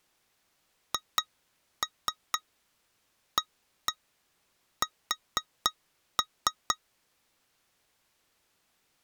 Tap code, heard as taps on glass, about 4 knocks a second. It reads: HAS